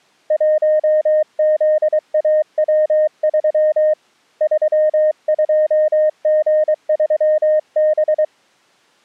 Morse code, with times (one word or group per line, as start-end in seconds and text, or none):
0.3-3.9 1ZAW3
4.4-8.2 32G3B